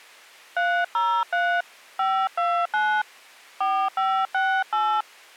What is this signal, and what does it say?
DTMF, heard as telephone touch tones, dialled by hand, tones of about 280 ms. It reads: 303 529 4568